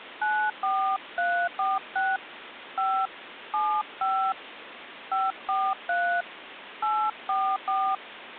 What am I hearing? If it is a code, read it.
DTMF, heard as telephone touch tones, dialled by hand, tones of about 280 ms, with phone line noise. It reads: 94346 5 75 543 844